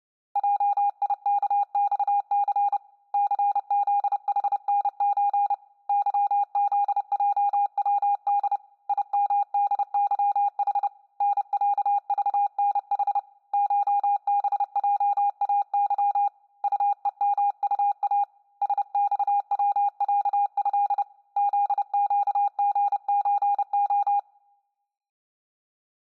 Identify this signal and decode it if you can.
Morse code (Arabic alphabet), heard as a keyed tone, hand-sent with a paddle, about 30 wpm, 810 Hz. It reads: جيكصث ثذحنز ظذجود يمدظح نعضنح شبجاظ طءمطا سصوعه ذقغزخ